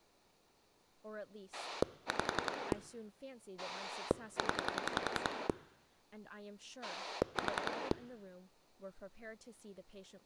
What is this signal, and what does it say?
Pulse dialling, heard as a rotary dial, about 10 pulses a second, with speech in English. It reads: 5 0 4